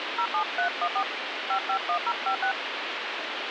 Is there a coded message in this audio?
Yes: DTMF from 0.2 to 2.5 s, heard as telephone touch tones, dialled by hand, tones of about 80 ms, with phone line noise. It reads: 07314 551056